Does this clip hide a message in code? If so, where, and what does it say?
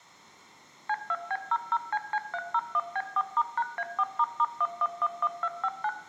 Yes: DTMF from 0.9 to 5.9 s, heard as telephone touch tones, dialled by machine, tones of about 50 ms, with room echo. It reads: C2B00CC301B4*#A4**1111259